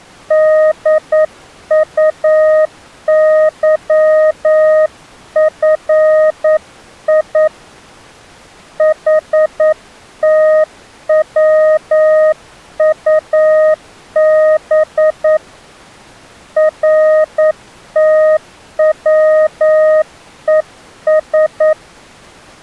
Morse code, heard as a keyed tone, hand-sent with a paddle, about 9 wpm, 620 Hz. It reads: DUYFI HTWUB RTWES